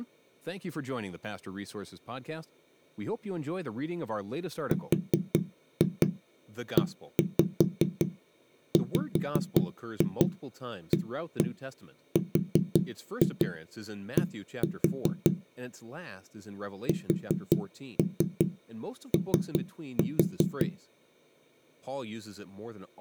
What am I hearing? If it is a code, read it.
Tap code, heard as knocks on a wall, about 5 knocks a second, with speech in English. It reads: REWARD SO